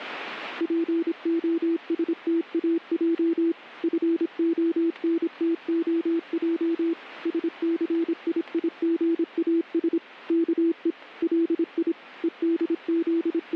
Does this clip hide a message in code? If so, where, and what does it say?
Yes: Morse code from 0.5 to 13.6 s, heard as a keyed tone, machine-sent, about 26 wpm, 330 Hz. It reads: POSTAJ FONTOJ SCIIGAS KE LI …